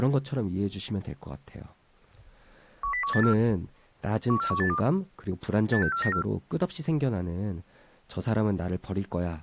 Five-tone selective call (CCIR), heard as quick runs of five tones, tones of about 100 ms, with speech in Korean. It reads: 10184 14182 86494